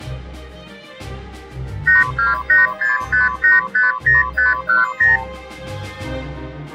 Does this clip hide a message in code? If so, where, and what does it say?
Yes: multi-frequency trunk signalling (R2, with the far end's replies) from 1.9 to 5.2 s, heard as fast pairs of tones, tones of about 160 ms. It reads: 82865850510